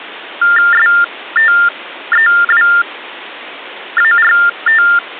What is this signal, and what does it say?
TTY/TDD text telephone tones (45.45 baud Baudot), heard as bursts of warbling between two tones, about 400 Hz shift, 1600 Hz centre. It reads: STEWART